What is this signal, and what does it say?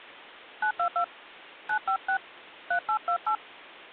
DTMF, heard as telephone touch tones, dialled by hand, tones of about 90 ms. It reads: 922 956 3828